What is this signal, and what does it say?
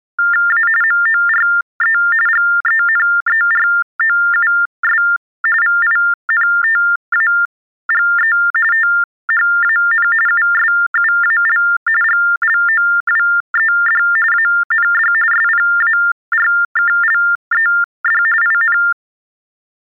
TTY/TDD text telephone tones (45.45 baud Baudot), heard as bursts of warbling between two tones, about 400 Hz shift, 1600 Hz centre. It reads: A MORE GENEROUS VINTAGE THAN USUAL GLOWED AND SPARKLED IN